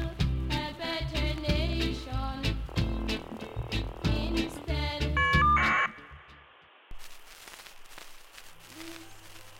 Caller ID data burst, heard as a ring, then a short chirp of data, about 1200 baud.